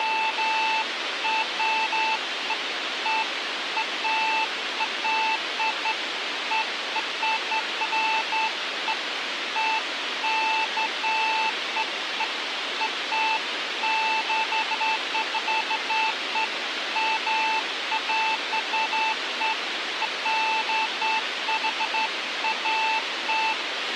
Beeps of irregular length, with radio hiss and a squelch burst at the end. There is no code.